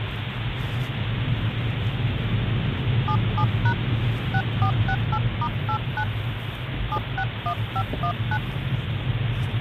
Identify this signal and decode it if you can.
DTMF, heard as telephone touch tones, dialled by hand, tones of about 70 ms, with phone line noise and the noise inside a car. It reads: 77# 6468*89 761519